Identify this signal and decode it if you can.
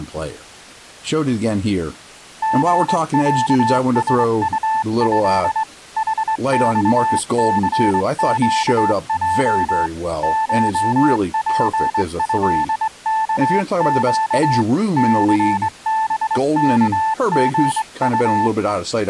Morse code (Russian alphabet), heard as a keyed tone, hand-sent with a straight key, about 22 wpm, 880 Hz, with speech in English. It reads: ГЯСУЭ ХЬЦЩЙ ШПЭКЩ ЦБКГУ